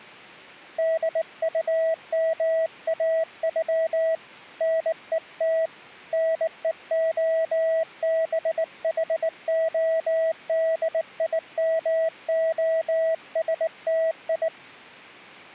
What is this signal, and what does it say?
Morse code (Russian alphabet), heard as a keyed tone, hand-sent with a bug key, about 19 wpm, 650 Hz. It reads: ДУМАЮ НЕТ НЕОБХОДИМОСТИ